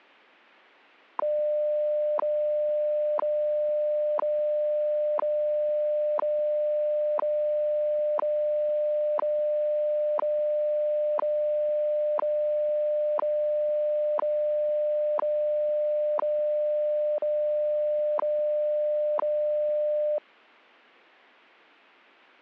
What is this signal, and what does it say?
Radio time signal (WWV, Colorado), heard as ticks, one a second.